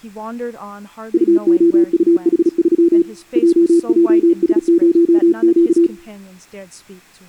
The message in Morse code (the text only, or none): UOUH3 JJS0Q